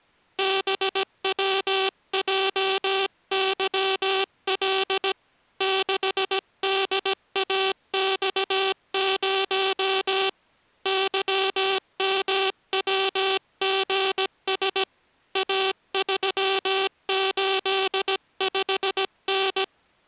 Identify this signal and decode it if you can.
Morse code, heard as a buzzer, hand-sent with a paddle, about 17 wpm. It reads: BWJYL 6DAX0 YMWGS A385N